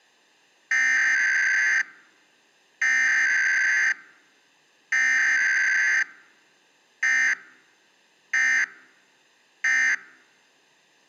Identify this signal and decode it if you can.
Emergency Alert System (SAME) tones (header bursts, then end-of-message bursts), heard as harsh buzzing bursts, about 520.83 baud.